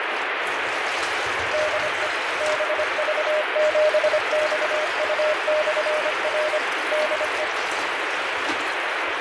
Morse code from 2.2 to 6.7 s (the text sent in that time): BV7XU/R